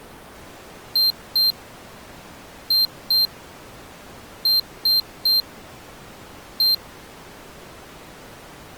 Beep code, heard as a piezo beeper, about 4150 Hz. 2-2-3-1. In Phoenix BIOS tables: unexpected interrupt.